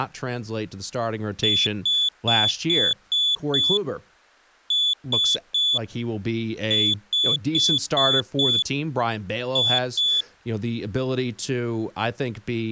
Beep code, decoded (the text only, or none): 6-3-5-2